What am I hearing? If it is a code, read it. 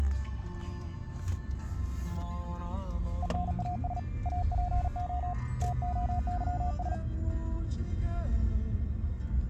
Morse code (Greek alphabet), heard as a keyed tone, hand-sent with a paddle, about 39 wpm, 720 Hz, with the noise inside a car. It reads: ΕΝΑΣ ΑΠΟ ΤΟΥΣ